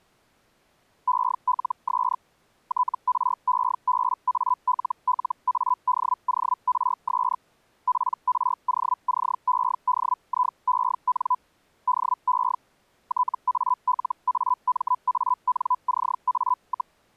Hellschreiber (Feld-Hell, 122.5 baud), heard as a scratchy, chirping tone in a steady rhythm, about 1000 Hz. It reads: ELS TREBALLADORS PROCEDIEN DE TALAMANCA,